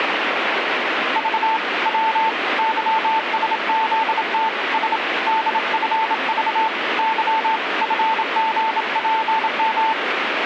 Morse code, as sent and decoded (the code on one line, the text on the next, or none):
...- / .-- / -.-- ... --.. - / ... / -.. ..-. ...- / -.-- / ..-. --. .--. --
V W YSZT S DFV Y FGPM